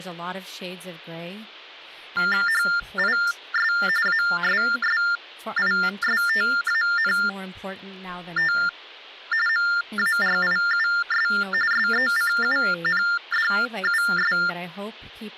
TTY/TDD text telephone tones (45.45 baud Baudot), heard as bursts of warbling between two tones, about 400 Hz shift, 1600 Hz centre, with speech in English. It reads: HIS ASSISTANT MARIUS SECUNDUS